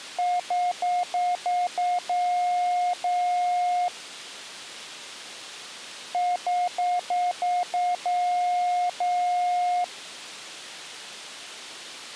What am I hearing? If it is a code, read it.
Beep code, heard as beeps, played twice, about 720 Hz. 6 short, 2 long.